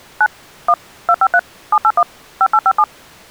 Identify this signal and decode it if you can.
DTMF, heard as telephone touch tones, dialled by machine, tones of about 60 ms. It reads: 9 1 253 781 5857